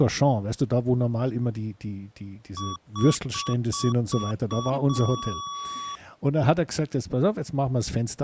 Beep code, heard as beeps from a small speaker, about 1130 Hz, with speech in German. 6 short, 1 long.